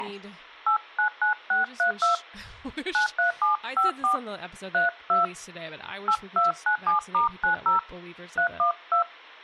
DTMF, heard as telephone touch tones, dialled by hand, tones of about 110 ms, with speech in English. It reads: 899632 93754 32 8297*90 312